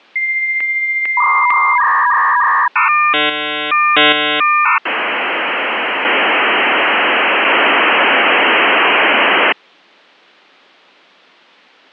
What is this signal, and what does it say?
Dial-up modem handshake (V.34 or later), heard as a whistle, warbles, then hiss.